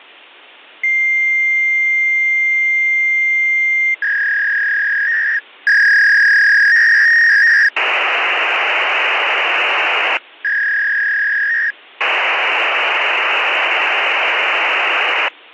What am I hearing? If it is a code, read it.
Fax machine handshake, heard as a long tone, a warble and hiss.